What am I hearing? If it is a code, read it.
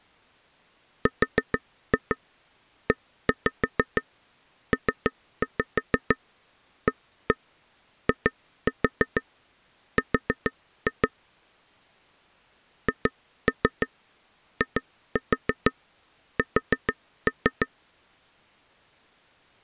Tap code, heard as taps on a table, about 6 knocks a second. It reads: REPAIR HIS